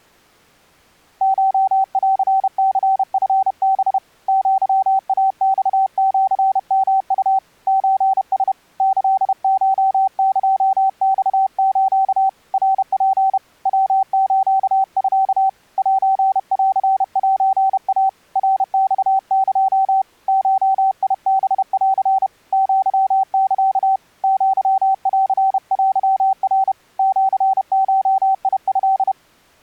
Morse code (Japanese Wabun code), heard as a keyed tone, hand-sent with a paddle, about 31 wpm, 770 Hz. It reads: コンニチハ アイマシヨウ ソラ キコエマス ナツ ヤスミ センセイ ナマエ ゴハン アサ アンテナ シゴト